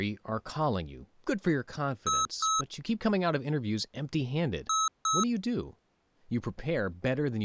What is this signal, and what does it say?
Beep code, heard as beeps from a small speaker, played twice, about 1290 Hz, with speech in English. 2 short. In AMI BIOS tables: memory parity error; in IBM BIOS tables: self-test error shown on screen; in Dell tables: no memory detected.